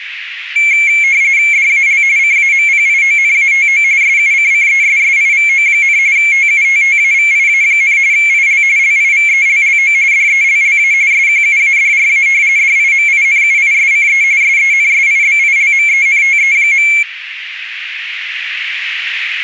RTTY (45.45 baud, 170 Hz shift), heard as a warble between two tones, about 2250 Hz centre, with radio static. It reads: DAL CAMPIONATO SUCCESSIVO, TUTTAVIA, IL LIVELLO DELLA SQUADRA DIMINUISCE SENSIBILMENTE.